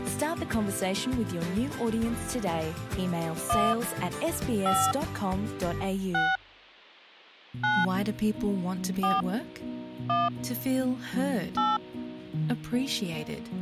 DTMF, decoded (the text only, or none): 1 5 6 9 4 1 8